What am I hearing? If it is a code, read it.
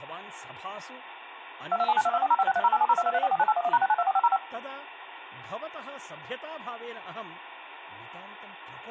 DTMF, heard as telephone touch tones, dialled by machine, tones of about 40 ms, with phone line noise, room echo and speech in Sanskrit. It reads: 227922405630870223449811#6924505